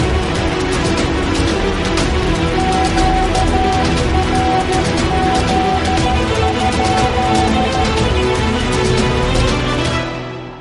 Morse code, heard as a keyed tone, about 13 wpm, 750 Hz, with radio static and a narrow filter. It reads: QRZ?